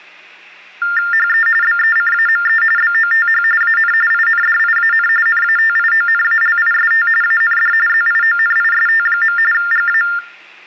TTY/TDD text telephone tones (45.45 baud Baudot), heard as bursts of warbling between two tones, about 400 Hz shift, 1600 Hz centre, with hum. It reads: HE BECAME BOTH AN INDIAN NATIONALIST AND ZIONIST. GA